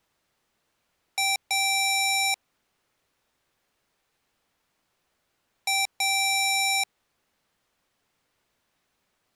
Beep code, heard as beeps from a small speaker, played twice, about 780 Hz. 1 short, 1 long.